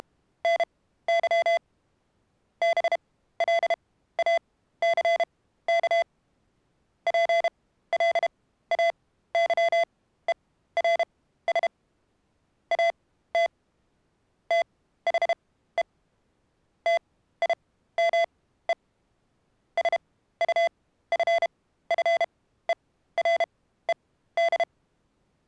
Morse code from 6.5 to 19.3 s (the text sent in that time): PLAYERS AT THE TIME